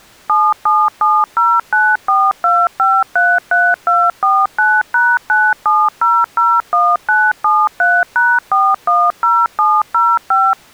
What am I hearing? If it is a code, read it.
DTMF, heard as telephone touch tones, dialled by machine, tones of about 230 ms. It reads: 7770942533249#97001973#410705